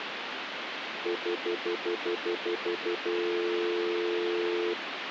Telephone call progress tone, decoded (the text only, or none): stutter dial tone